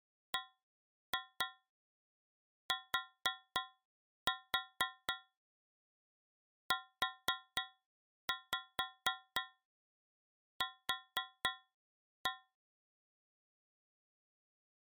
Tap code, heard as taps on a metal pipe, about 4 knocks a second. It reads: BTUQ